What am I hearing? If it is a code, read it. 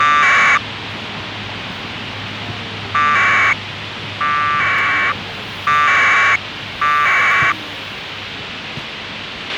Packet radio (AX.25, as in APRS), 1200 baud, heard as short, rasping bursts, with radio hiss, a squelch burst at the end and the noise of a residential street.